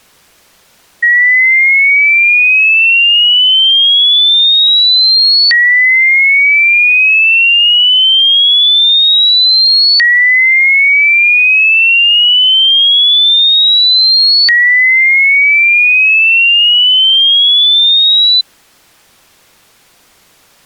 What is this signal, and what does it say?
A tone that sweeps in pitch again and again. There is no code.